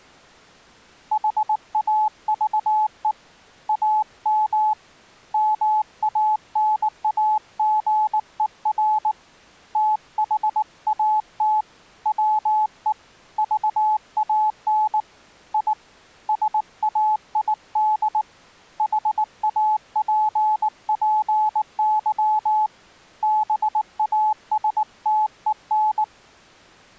Morse code, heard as a keyed tone, hand-sent with a paddle, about 19 wpm, 860 Hz. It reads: HAVE AM MANAGER THAT WE VAN I SAID HAPPY BASTEN